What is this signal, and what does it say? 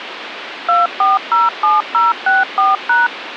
DTMF, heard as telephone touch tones, dialled by machine, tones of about 170 ms, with phone line noise. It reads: 2407064#